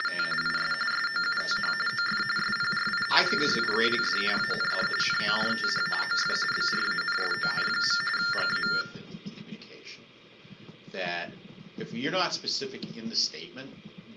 TTY/TDD text telephone tones (45.45 baud Baudot), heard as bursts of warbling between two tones, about 400 Hz shift, 1600 Hz centre. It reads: … IS SOUTH OF SPRINGFIELD AND NORTH OF BRANSON. GA